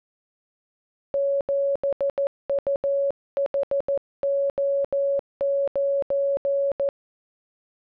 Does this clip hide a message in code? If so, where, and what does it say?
Yes: Morse code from 1.1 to 6.9 s, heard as a keyed tone, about 14 wpm, 560 Hz. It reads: 7UHO9